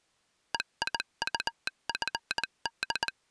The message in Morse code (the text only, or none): EIUFD